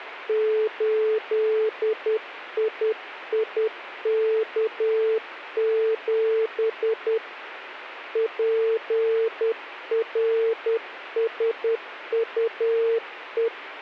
Morse code, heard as a keyed tone, hand-sent with a paddle, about 10 wpm, 450 Hz, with radio static. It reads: 8IIK7 PRSUE